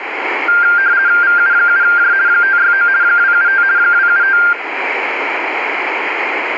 RTTY (50 baud, 170 Hz shift), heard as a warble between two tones, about 1490 Hz centre, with radio static. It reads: VU7J 569 275 275